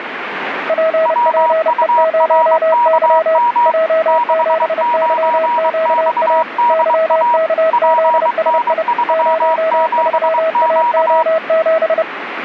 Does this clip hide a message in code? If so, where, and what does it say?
Yes: Morse code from 0.6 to 12.1 s, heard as two keyed tones, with radio static. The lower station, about 30 wpm, 640 Hz: PPE0Y J7YQA YKZSI 03AO7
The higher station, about 23 wpm, 960 Hz: WURKM 69XDA PN37Q